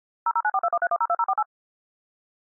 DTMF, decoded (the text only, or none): 0094213102048